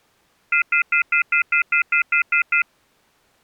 Telephone call progress tone (North American plan), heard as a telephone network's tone, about 1400, 2050, 2450, 2600 Hz, 0.1 s on and 0.1 s off. Off-hook warning tone.